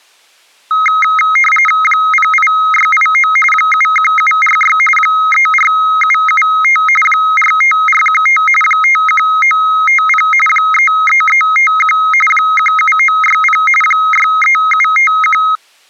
RTTY (45.45 baud, 850 Hz shift), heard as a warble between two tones, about 1700 Hz centre. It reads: 08689 71746 34775 45415 51950 33351 17960 63751